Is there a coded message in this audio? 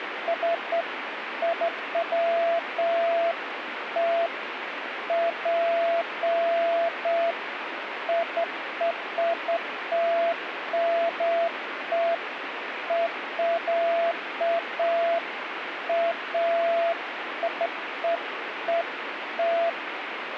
No, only beeps of irregular length, with radio static.